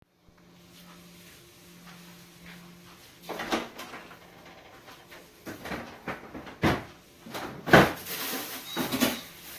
Kitchen noise. There is no code.